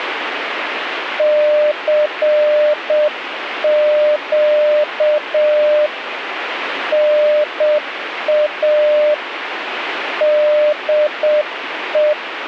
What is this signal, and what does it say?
Morse code, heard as a keyed tone, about 7 wpm, 600 Hz, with radio static. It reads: CQ NA DE